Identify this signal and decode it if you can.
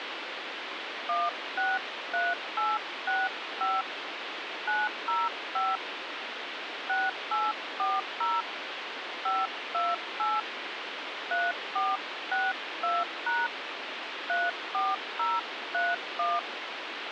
DTMF, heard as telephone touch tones, dialled by hand, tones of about 200 ms, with phone line noise. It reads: 163865 905 6840 528 3462# 34031